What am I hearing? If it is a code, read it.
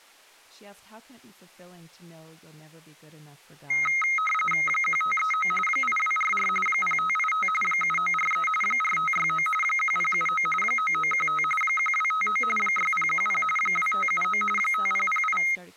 RTTY (45.45 baud, 850 Hz shift), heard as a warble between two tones, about 1700 Hz centre, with speech in English. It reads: 1539 8244 0585 7943 4569 1079 9915 1259 6010 2579 5008